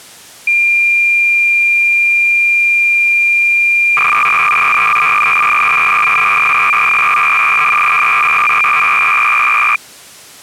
Cassette data (Kansas City type), 300 baud, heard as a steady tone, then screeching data.